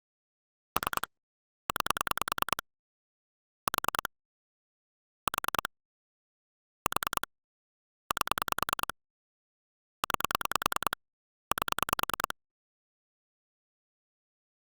Pulse dialling, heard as clicks on a phone line, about 10 pulses a second. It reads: 3 9 4 4 4 8 9 8